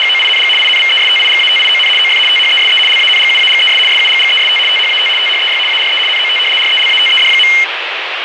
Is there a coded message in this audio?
Yes: RTTY (75 baud, 850 Hz shift) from 0.0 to 7.6 s, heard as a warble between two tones, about 2550 Hz centre, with radio static. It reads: … INVESTIGATION OF THESE LANGUAGES SUGGEST THAT THEY ARE NOT RELATED.